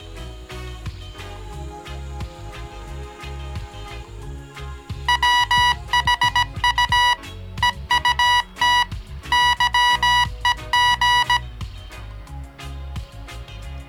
Morse code, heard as electronic beeps, machine-sent, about 17 wpm, 980 Hz. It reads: WHU EUT YEG